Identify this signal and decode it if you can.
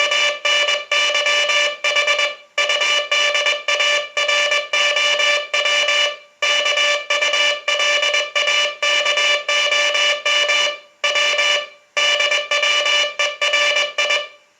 Morse code (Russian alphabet), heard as a buzzer, hand-sent with a paddle, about 21 wpm, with room echo. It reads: … УДАРОВ КУЛАКОМ В ДВЕРИ